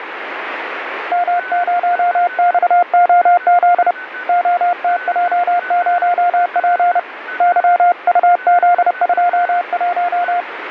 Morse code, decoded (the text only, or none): M0XOZ OTJ0P YUZ21